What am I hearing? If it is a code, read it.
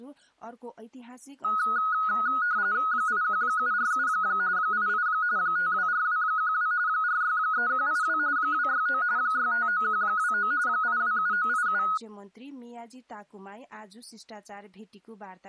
RTTY (45.45 baud, 170 Hz shift), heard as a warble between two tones, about 1360 Hz centre. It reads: 81747 88 524212 463182 269 659129 827987